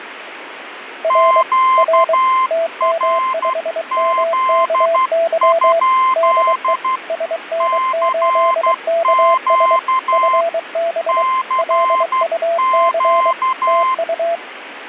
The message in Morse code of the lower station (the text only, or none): R R TM5MKY DE SN8KS FB LUC TU